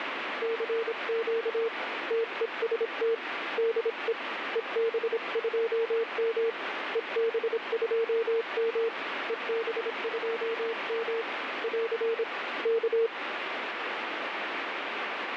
Morse code, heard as a keyed tone, hand-sent with a paddle, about 26 wpm, 460 Hz, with radio static. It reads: CQ TEST DE EB2M EB2M EB2M <AR> K